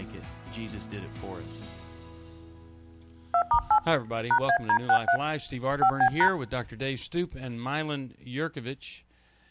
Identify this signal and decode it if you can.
DTMF, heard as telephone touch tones, dialled by hand, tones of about 80 ms. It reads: 2*8 #AD63 5B#